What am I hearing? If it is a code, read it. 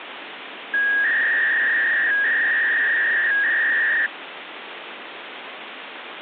300-baud modem data (V.21 tones), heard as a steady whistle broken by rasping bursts, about 300 baud, 200 Hz shift, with phone line noise.